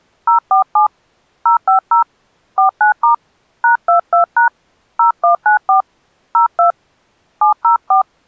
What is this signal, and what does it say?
DTMF, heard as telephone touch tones, dialled by hand, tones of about 120 ms. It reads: 047 050 49* #22# 0194 02 704